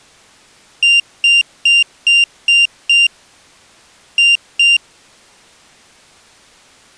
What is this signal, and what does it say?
Beep code, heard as a piezo beeper, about 2800 Hz. 6-2.